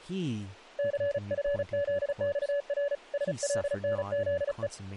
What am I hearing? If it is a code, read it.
Morse code, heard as a keyed tone, hand-sent with a paddle, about 35 wpm, 570 Hz, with speech in English. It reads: CFZXR SLNZE